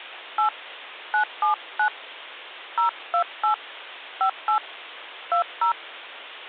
DTMF, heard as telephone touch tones, dialled by hand, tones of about 110 ms. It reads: 8 979 028 58 20